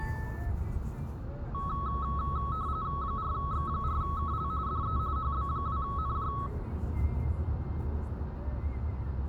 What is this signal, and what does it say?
RTTY (45.45 baud, 170 Hz shift), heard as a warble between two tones, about 1200 Hz centre, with radio static, room echo and the noise inside a car. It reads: 4X4KL DE HB2NJ